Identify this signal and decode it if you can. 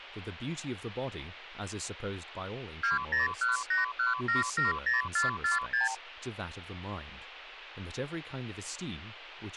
Multi-frequency trunk signalling (R2, with the far end's replies), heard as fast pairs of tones, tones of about 140 ms, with speech in English. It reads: 20181770446